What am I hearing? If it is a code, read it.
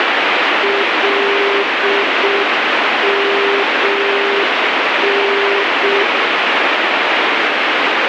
Morse code, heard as a keyed tone, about 6 wpm, 400 Hz, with heavy radio static. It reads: LMN